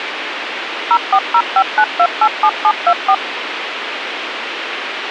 DTMF, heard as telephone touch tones, dialled by machine, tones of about 60 ms, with radio hiss. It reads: 04059287724